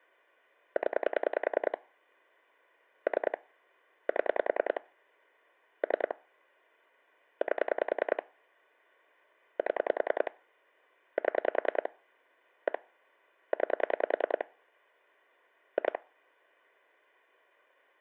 Pulse dialling, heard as clicks on a phone line, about 10 pulses a second. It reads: 0 3 7 3 8 7 7 1 9 2